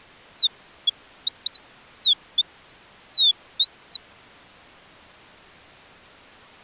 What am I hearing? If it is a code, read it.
Bird-like chirps. There is no code.